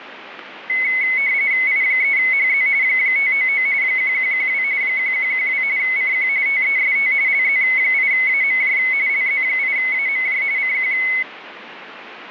RTTY (45.45 baud, 170 Hz shift), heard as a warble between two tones, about 2150 Hz centre, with radio static. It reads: I3HZ 599 1112 1112 CQ TEST LZ8AMJ LZ8AMJ CQ